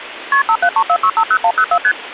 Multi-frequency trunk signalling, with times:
0.3-0.4 KP
0.5-1.8 5734650104
1.8-1.9 ST

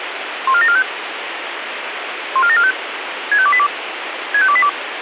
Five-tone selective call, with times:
0.5-0.8 14745
2.4-2.7 14745
3.3-3.7 65282
4.3-4.7 65282

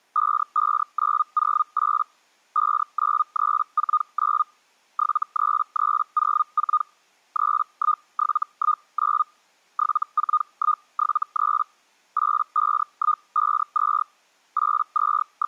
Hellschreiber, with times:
0.2-2.0 55908
2.6-4.4 59349
5.0-6.8 73304
7.4-9.2 31719
9.8-11.6 74173
12.2-14.0 85152
14.6-15.5 …

